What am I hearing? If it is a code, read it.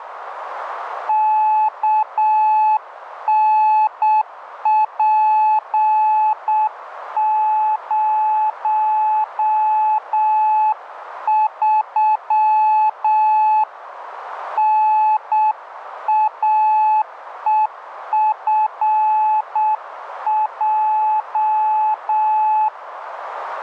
Morse code, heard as a keyed tone, hand-sent with a paddle, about 7 wpm, 860 Hz, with radio static. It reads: KNP03 NAEFJ